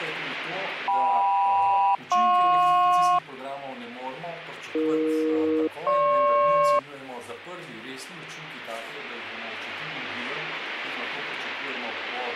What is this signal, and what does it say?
Aircraft SELCAL, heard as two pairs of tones, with radio static. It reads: KM-JP AE-GP